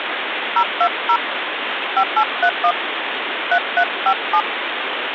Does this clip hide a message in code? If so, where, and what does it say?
Yes: DTMF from 0.6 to 4.4 s, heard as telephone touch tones, dialled by hand, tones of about 70 ms, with phone line noise. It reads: 020 5831 3357